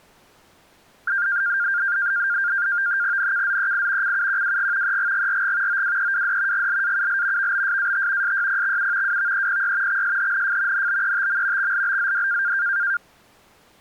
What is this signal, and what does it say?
NAVTEX (SITOR-B), 100 baud, 170 Hz shift, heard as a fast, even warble, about 1500 Hz centre. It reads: NKZEI CUQWG EGGRG OWEWD GLAUL VBSAT SYPXU WVEPY XSHNF NBETM XLBZD